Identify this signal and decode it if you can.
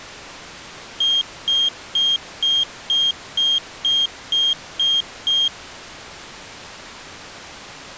Beep code, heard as a piezo beeper, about 3200 Hz. 10 short. In AMI BIOS tables: CMOS shutdown register error.